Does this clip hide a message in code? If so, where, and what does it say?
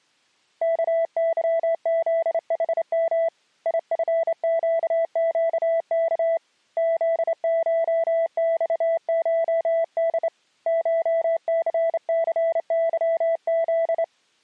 Yes: Morse code (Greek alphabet) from 0.6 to 14.1 s, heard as a keyed tone, hand-sent with a straight key, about 28 wpm, 660 Hz. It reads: ΚΥΖΗΜ ΙΦΨΨΚ ΖΧΞΧΔ ΧΘΘΥΖ